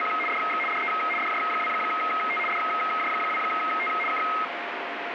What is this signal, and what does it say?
RTTY (75 baud, 850 Hz shift), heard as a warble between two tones, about 1700 Hz centre, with radio static. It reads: … DX DE DJ2T DJ2T K